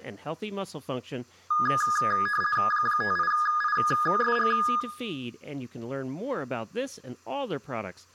RTTY (50 baud, 450 Hz shift), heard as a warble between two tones, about 1450 Hz centre, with room echo and speech in English. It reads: 58ISG